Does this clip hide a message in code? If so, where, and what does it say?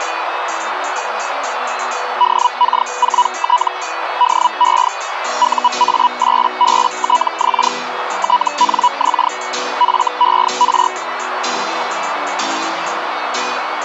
Yes: Hellschreiber (Feld-Hell, 122.5 baud) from 2.2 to 10.9 s, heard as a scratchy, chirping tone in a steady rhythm, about 980 Hz, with radio static and a narrow filter. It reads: DK4T DE UA8BTX TNX FER